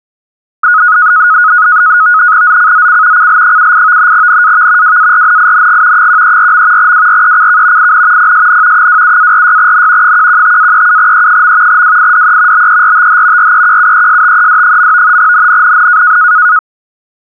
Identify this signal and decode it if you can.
NAVTEX (SITOR-B), 100 baud, 170 Hz shift, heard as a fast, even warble, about 1360 Hz centre. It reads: ZCZC CL78 NAV WARNING 134. WRECK IN PSN 27-46N 115-37E. WIDE BERTH REQUESTED. NNNN